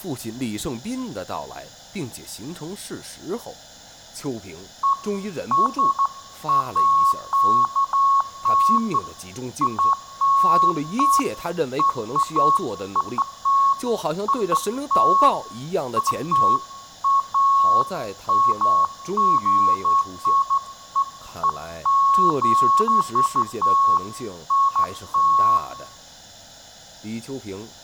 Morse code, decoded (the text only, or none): none